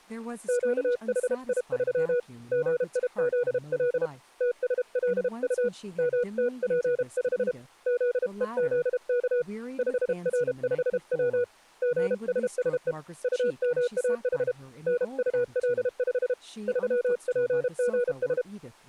Morse code, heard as a keyed tone, hand-sent with a paddle, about 32 wpm, 490 Hz, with speech in English. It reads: QHI3 GIZL TSLU MTP5 ZEZK 5R5W GSSE UMAH NUL5 3PGS